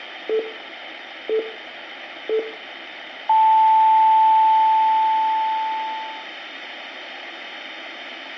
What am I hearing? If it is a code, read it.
Radio time signal (three low pips and a long one an octave up, as on NHK), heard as pips.